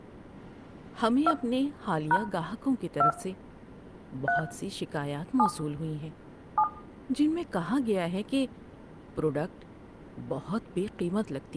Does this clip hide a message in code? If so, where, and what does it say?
Yes: DTMF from 1.3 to 6.6 s, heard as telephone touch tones, dialled by hand, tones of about 80 ms, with room echo and speech in Urdu. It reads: 2 # 2 3 7 7